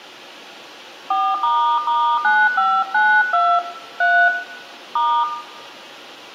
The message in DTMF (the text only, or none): 4**9592 3 *